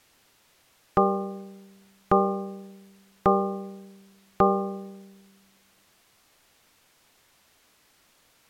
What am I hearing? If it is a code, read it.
Clock strike, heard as a bell. 4. Four o'clock.